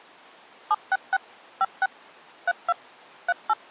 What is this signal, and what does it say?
DTMF, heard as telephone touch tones, dialled by machine, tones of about 40 ms. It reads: 766 56 32 38